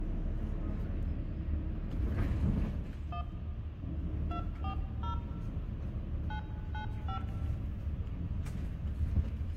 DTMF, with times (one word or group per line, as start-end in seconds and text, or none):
3.1-3.2 1
4.3-5.1 240
6.3-7.2 995